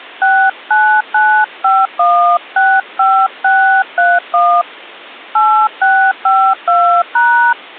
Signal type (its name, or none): DTMF